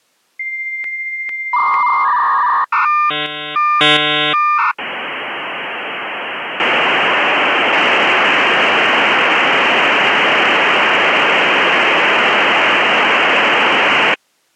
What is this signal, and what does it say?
Dial-up modem handshake (V.34 or later), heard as a whistle, warbles, then hiss.